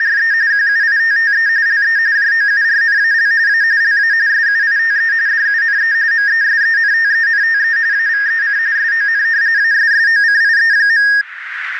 RTTY (45.45 baud, 170 Hz shift), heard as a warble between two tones, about 1750 Hz centre, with radio static and a narrow filter. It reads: … QUITTE LE JOURNAL A LA SUITE DUNE MESENTENTE AVEC SON ASSOCIE.